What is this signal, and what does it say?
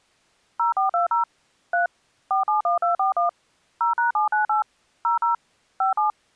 DTMF, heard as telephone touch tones, dialled by machine, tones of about 130 ms. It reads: 0420 3 471241 0#798 00 57